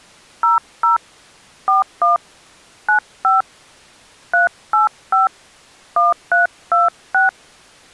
DTMF, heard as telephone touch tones, dialled by hand, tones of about 140 ms. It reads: 00 41 95 385 1326